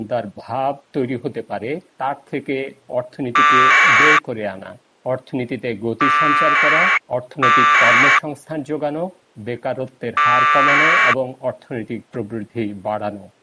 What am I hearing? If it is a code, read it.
Packet radio (AX.25, as in APRS), 1200 baud, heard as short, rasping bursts.